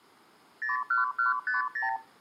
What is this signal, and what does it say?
Multi-frequency trunk signalling (R2, with the far end's replies), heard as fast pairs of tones, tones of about 140 ms. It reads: 01150